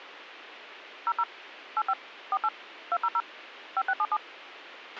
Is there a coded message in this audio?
Yes: DTMF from 1.1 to 4.2 s, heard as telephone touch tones, dialled by machine, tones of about 50 ms, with a squelch burst at the end. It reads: 00 85 48 200 5677